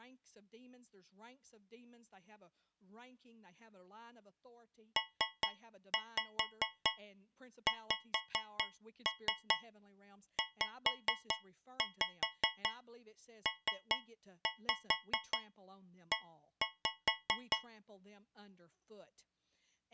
Tap code, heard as taps on a metal pipe, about 4 knocks a second, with speech in English. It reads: PXZPE